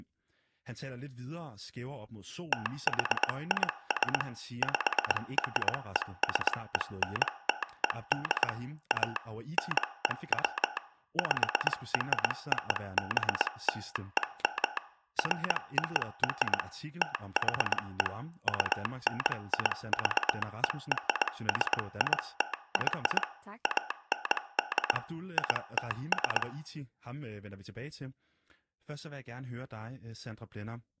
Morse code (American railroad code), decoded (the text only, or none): THIS PRESENTED A NEW PROBLEM FOR THE UNIVERSITY AND ITS